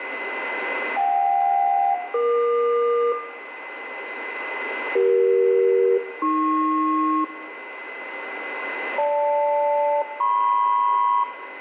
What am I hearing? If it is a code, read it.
Aircraft SELCAL, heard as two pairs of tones, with radio static, a steady whistle near 2030 Hz and room echo. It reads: JK-EQ CE-AP GL-MP